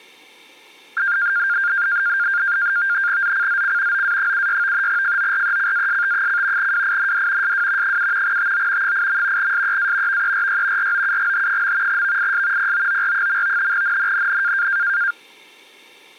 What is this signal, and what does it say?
NAVTEX (SITOR-B), 100 baud, 170 Hz shift, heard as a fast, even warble, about 1500 Hz centre. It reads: ZCZC OA76 FORECAST: WIND SW 7 TO 8. SEA VERY ROUGH. VIS POOR. NNNN